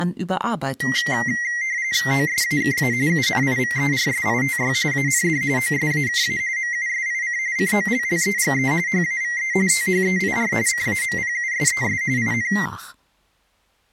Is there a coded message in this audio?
Yes: RTTY (45.45 baud, 170 Hz shift) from 0.8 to 12.7 s, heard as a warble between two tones, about 2000 Hz centre, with speech in German. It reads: OSAKA UNIVERSITY AND OSAKA MUSIC COLLEGE HAVE THEIR CAMPUSES IN